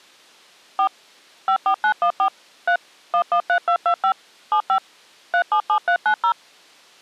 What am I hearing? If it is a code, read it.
DTMF, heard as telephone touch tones, dialled by machine, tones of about 80 ms. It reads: 4 54914 3 113225 75 377390